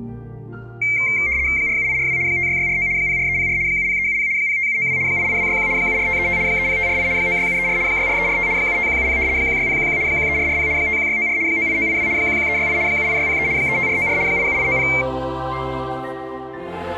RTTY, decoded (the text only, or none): 47842 56649 04304 70370 05792 88261 74535 30548 96734 64345 75170 16011 13440 51694 98982 11368 78603 35494 87890